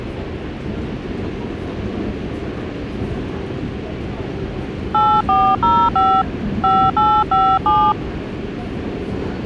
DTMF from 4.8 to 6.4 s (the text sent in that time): 8405